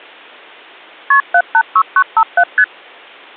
Multi-frequency trunk signalling (R1, as on North American trunks), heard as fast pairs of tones, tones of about 60 ms. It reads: KP 786957 ST